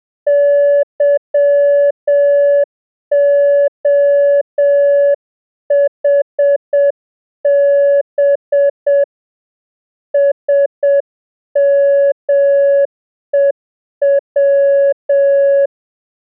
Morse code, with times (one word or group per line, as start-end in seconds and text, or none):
0.3-9.0 YOHB
10.1-15.7 SMEW